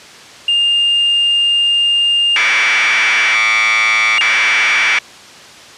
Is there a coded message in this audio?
Yes: Commodore tape loading (standard loader) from 0.5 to 5.0 s, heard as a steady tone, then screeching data.